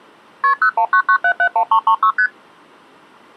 Multi-frequency trunk signalling (R1, as on North American trunks), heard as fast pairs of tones, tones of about 80 ms. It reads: KP 0199771336 ST